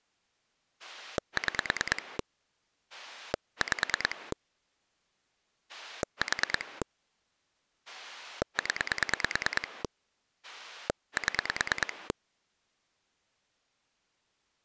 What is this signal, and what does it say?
Pulse dialling, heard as a rotary dial, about 9 pulses a second. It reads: 6 5 4 0 7